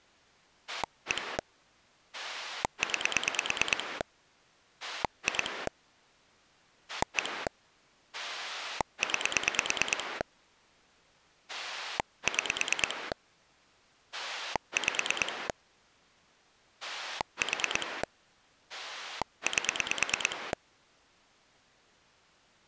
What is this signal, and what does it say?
Pulse dialling, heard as a rotary dial, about 9 pulses a second. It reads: 1 9 2 1 9 6 5 4 8